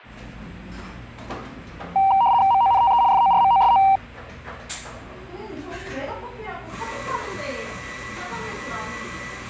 RTTY (75 baud, 170 Hz shift), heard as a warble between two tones, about 860 Hz centre, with the noise of a cafe. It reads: MONTE FORMOSO